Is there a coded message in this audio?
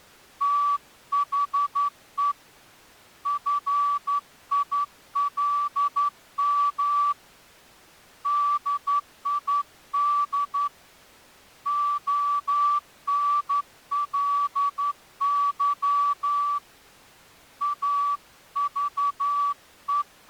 Yes: Morse code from 0.4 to 20.3 s, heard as a whistle, hand-sent with a straight key, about 11 wpm. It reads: THE FILM DID ONLY …